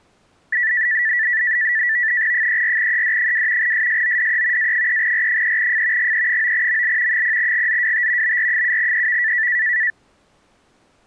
NAVTEX (SITOR-B), 100 baud, 170 Hz shift, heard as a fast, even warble, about 1850 Hz centre. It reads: 34ED2 SSODE A3R3F GE9ML 0GZWT BR7EV